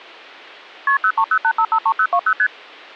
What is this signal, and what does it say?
Multi-frequency trunk signalling (R1, as on North American trunks), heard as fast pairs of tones, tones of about 70 ms. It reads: KP 0308553020 ST